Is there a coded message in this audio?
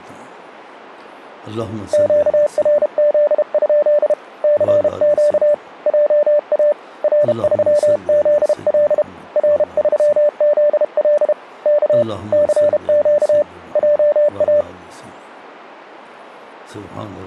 Yes: Morse code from 1.9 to 14.7 s, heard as a keyed tone, hand-sent with a paddle, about 32 wpm, 590 Hz. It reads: QRZ? CQ JA R3ZL R3ZL K CQ JA